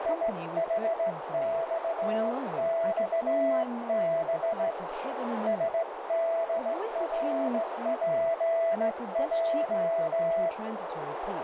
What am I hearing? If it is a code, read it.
Morse code, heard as a keyed tone, hand-sent with a straight key, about 16 wpm, 660 Hz, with heavy radio static, a narrow filter and speech in English. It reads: IHXXB SDRPJ